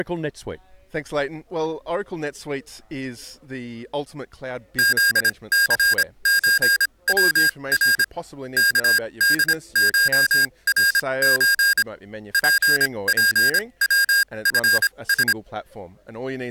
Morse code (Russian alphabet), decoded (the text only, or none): ЗЦЧВР КДШРЧ ППВФС